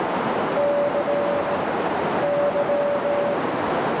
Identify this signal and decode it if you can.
Morse code, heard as a keyed tone, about 17 wpm, 580 Hz, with heavy radio static and a narrow filter. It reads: C Y